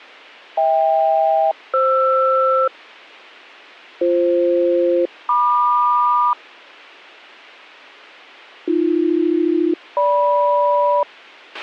Aircraft SELCAL, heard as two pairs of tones, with a squelch burst at the end. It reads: HK-FR BF-MQ AB-GM